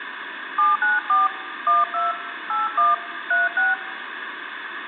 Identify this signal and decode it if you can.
DTMF, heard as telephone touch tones, dialled by hand, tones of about 170 ms, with phone line noise. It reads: 794 12 81 36